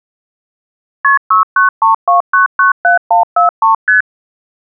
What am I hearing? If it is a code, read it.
Multi-frequency trunk signalling (R1, as on North American trunks), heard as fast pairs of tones, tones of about 130 ms. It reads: KP 6932997143 ST